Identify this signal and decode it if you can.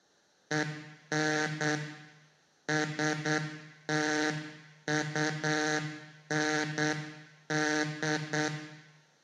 Morse code, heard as a buzzer, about 8 wpm, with room echo. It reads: EN STUND